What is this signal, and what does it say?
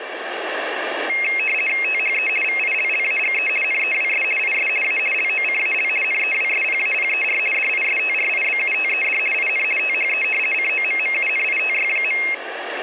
RTTY (50 baud, 450 Hz shift), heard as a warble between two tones, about 2350 Hz centre. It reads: THE VILLAGE NEWS IS A LOCAL NEWSPAPER DISTRIBUTED IN THE COMMUNITY.